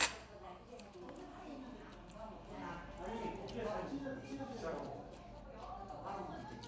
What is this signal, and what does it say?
The noise of a restaurant. There is no code.